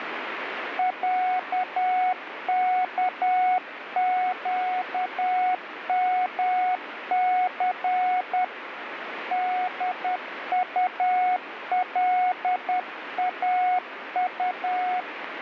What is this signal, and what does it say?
Morse code (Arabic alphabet), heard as a keyed tone, hand-sent with a paddle, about 10 wpm, 730 Hz, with radio static. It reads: عكقمث دطلاط